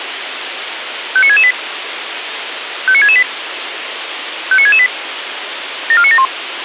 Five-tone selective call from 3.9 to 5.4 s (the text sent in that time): 59668